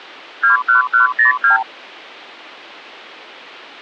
Multi-frequency trunk signalling (R2, with the far end's replies), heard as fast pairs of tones, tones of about 130 ms. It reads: 21102